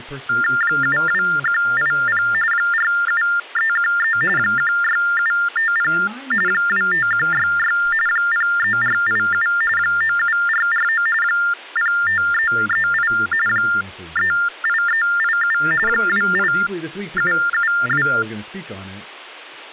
TTY/TDD text telephone tones (45.45 baud Baudot), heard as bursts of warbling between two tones, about 400 Hz shift, 1600 Hz centre, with speech in English. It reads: 72180 47313 16750 25166 03487 97449 05338 38387 28772